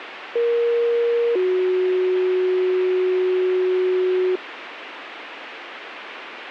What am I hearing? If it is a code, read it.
Two-tone page, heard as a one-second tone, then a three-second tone, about 470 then 370 Hz, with radio hiss and a squelch burst at the end.